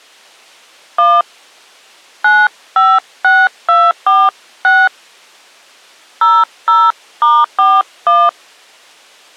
DTMF, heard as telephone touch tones, dialled by hand, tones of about 220 ms. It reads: 1 956246 00*41